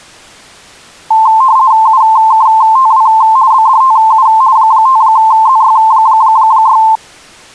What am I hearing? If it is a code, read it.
RTTY (50 baud, 170 Hz shift), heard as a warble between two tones, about 970 Hz centre. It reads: UKTW BDTU 5ZY6